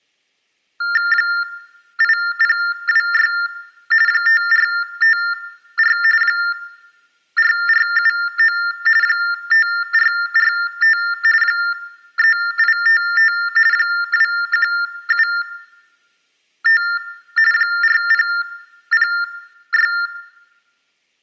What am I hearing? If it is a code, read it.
TTY/TDD text telephone tones (45.45 baud Baudot), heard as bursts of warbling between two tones, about 400 Hz shift, 1600 Hz centre, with room echo. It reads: 8026 5454 4479 5445 3855 2175 4006